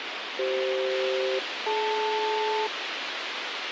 Aircraft SELCAL, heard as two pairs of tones, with radio hiss. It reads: CF-DL